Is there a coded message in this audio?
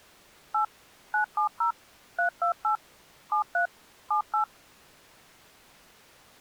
Yes: DTMF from 0.5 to 4.4 s, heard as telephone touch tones, dialled by machine, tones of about 110 ms. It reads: 8 970 328 73 78